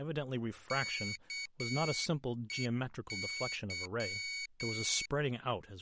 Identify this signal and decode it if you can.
Morse code, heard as a high beeper, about 8 wpm, 2250 Hz, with speech in English. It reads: KEY